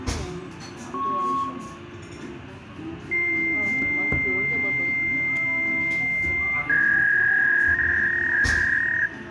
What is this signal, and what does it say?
Fax machine handshake, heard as a beep, a long tone and a warble, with room echo and the noise of a cafe.